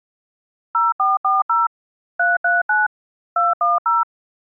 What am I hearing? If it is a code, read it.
DTMF, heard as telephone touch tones, dialled by machine, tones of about 180 ms. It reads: 0440 339 210